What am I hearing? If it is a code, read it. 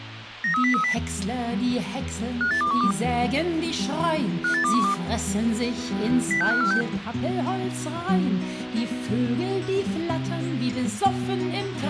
Five-tone selective call (CCIR), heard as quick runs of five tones, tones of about 100 ms, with radio hiss and a squelch burst at the end. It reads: 93030 58212 58212 06546